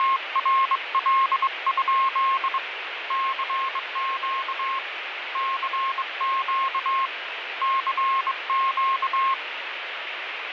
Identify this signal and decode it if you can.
Morse code, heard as a keyed tone, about 22 wpm, 1070 Hz, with radio static and fading. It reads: … CQ CQ CQ